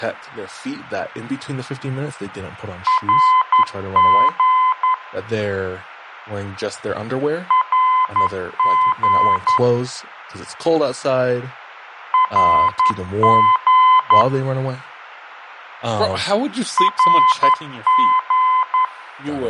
Morse code, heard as a keyed tone, machine-sent, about 11 wpm, 1020 Hz, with speech in English. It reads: RG RG RG RG